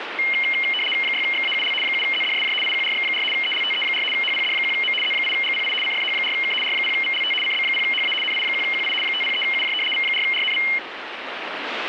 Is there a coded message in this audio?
Yes: RTTY (75 baud, 850 Hz shift) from 0.2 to 10.8 s, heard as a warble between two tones, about 2550 Hz centre, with radio static. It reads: 6XAUL 7ZDSJ IQRX4 ELTE4 HPD1M Z8GPI CFH4K R0VLT CB0HA NI1QI 503UJ V4RNV